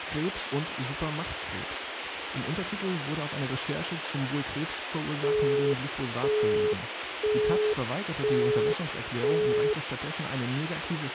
Telephone call progress tone (single-tone plan, as in Europe, Japan and elsewhere), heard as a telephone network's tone, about 420 Hz, 0.5 s on and 0.5 s off, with phone line noise and speech in German. Busy tone.